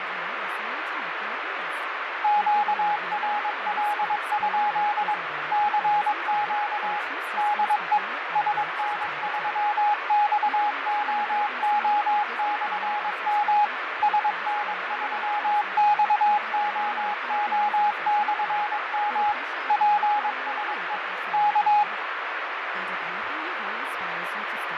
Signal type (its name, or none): Morse code